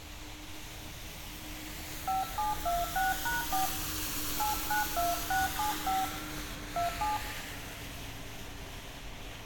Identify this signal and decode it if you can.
DTMF, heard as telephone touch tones, dialled by hand, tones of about 160 ms, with hum, room echo and street noise. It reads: 5726#4 892675 27